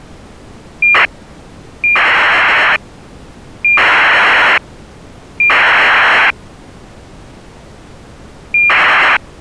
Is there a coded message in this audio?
Yes: ACARS aircraft data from 0.8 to 9.2 s, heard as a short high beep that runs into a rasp, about 2400 baud.